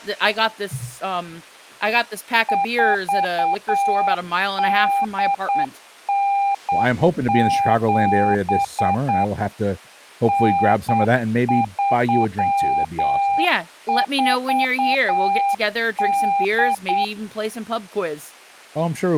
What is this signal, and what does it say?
Morse code (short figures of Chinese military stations), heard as a keyed tone, machine-sent, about 8 wpm, 800 Hz, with speech in English. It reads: 4897 9348